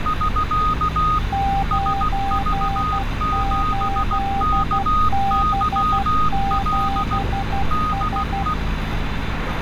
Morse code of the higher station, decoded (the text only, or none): <SK> SV7KYL DE